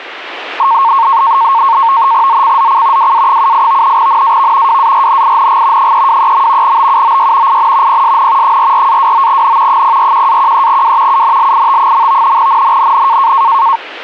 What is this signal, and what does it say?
NAVTEX (SITOR-B), 100 baud, 170 Hz shift, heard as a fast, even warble, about 1000 Hz centre. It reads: ZCZC WA78 NAV WARNING 323. BUOY IN PSN 44-29N 041-13W UNLIT. NNNN